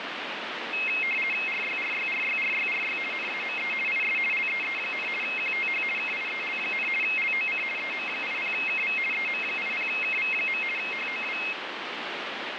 RTTY (50 baud, 450 Hz shift), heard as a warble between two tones, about 2350 Hz centre, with radio static. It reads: RYRYRYRYRY NAME IS LEE, QTH KIEL, LOC EM80KV EM80KV. HOW